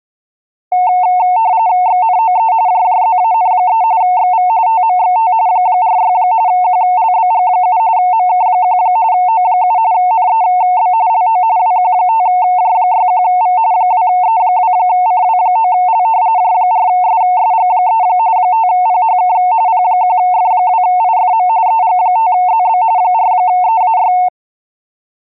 RTTY (45.45 baud, 170 Hz shift), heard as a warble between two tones, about 810 Hz centre. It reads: XNOE JJZAN3 XV TMXT 46 QLBG7 MK1 O7 NEB LO WQ5J61V 2E2CW9L J4SSG3 5PHK P1F2IFM EG5ZB 4EAY